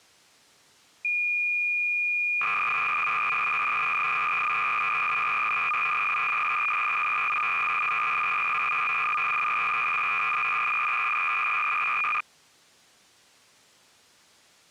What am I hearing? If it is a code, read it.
Cassette data (Kansas City type), 300 baud, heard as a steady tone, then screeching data.